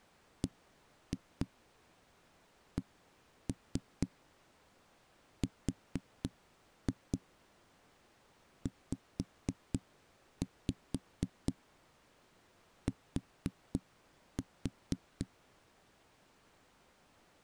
Tap code, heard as knocks on a wall, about 4 knocks a second. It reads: BCRZT